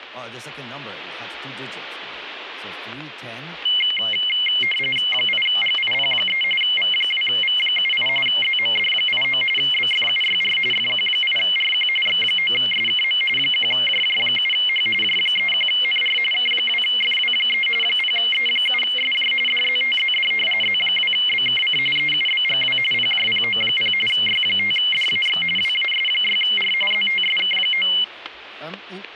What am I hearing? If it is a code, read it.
RTTY (45.45 baud, 850 Hz shift), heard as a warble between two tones, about 2550 Hz centre, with static crashes. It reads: 8GIP3 V2V78 ZMD89 BFUYR FQ8RQ X9SKM 1JJ7H J31NR K2FW3 0E7SJ DZTZD Z2BKC EUBGW PJPO0 Y5DAX WAS6R ZTSK9